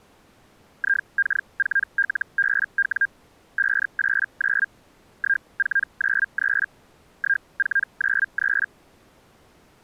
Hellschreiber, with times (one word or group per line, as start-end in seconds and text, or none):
0.8-3.1 IK4LBW
3.6-4.7 589
5.2-6.7 1493
7.2-8.7 1493